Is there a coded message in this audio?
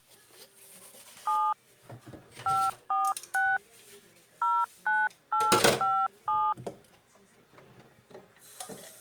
Yes: DTMF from 1.3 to 6.5 s, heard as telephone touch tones, dialled by hand, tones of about 220 ms, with kitchen noise. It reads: 7 546 09857